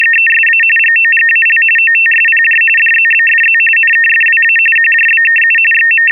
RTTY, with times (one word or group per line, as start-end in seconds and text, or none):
0.0-0.6 …
0.8-1.6 GOGAL
1.8-2.6 OTSPJ
2.8-3.6 DZBFZ
3.8-4.6 NKFWA
4.8-5.6 QJBKU
5.7-6.1 …